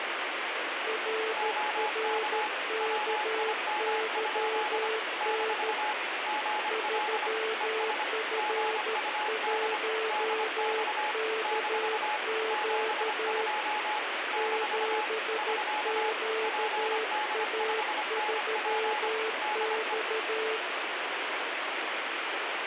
Morse code, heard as two keyed tones, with heavy radio static. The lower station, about 13 wpm, 440 Hz: RRKYN 3F1KQ 7QA3X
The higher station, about 25 wpm, 850 Hz: OK WIM? - GL ES GUD DX - 72 - <SK> PD5NP DE